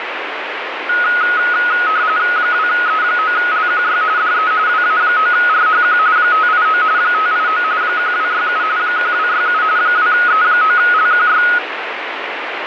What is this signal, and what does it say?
RTTY (45.45 baud, 170 Hz shift), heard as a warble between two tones, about 1360 Hz centre, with radio static. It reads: 2E9LQY DE WA9RHQ 589 589 1267 1267 2E9LQY